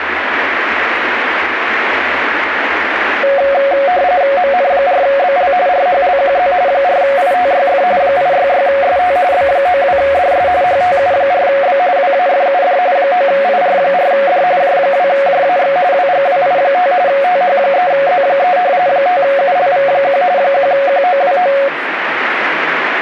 RTTY (45.45 baud, 170 Hz shift), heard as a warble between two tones, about 640 Hz centre, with radio static. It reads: MN4BL RHLQZ 4ITYF 866ST B92DS HTU4B WAFUD 9IR4D J2JAX WGWI5 TH3Z3 5ULV1 1QOWO